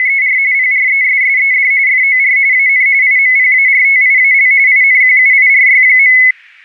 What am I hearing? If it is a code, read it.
RTTY (45.45 baud, 170 Hz shift), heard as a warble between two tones, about 2100 Hz centre. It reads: … PRESSED FOR AN IMPARTIAL INQUIRY.